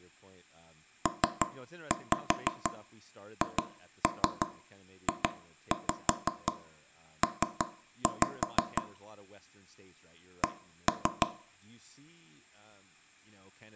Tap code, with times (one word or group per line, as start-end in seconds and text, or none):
1.1-8.8 PHJP
10.4-11.3 C